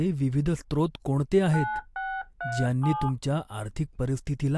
DTMF, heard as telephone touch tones, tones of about 260 ms, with speech in Marathi. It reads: 9637